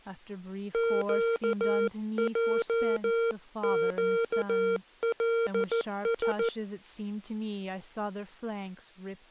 Morse code, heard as a keyed tone, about 14 wpm, 460 Hz, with speech in English. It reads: QJQLS